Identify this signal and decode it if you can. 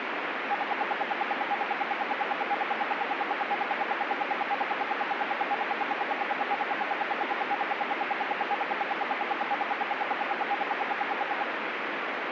Radio time signal (RWM, Moscow), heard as ten pulses a second, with radio static.